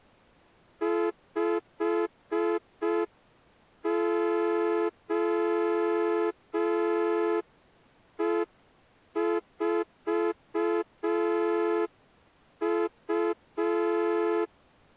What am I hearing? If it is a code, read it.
Morse code, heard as a horn, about 5 wpm. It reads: 5OE4U